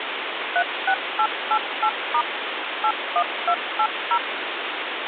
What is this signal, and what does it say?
DTMF, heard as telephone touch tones, dialled by machine, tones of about 70 ms, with phone line noise. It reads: 36888* 81280